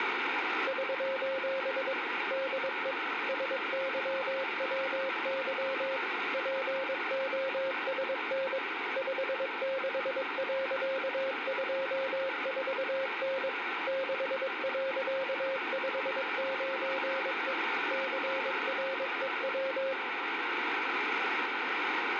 Morse code, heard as a keyed tone, machine-sent, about 22 wpm, 540 Hz, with radio static. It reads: <SOS> DE SYWY POSN 56.24N 6.59E CREW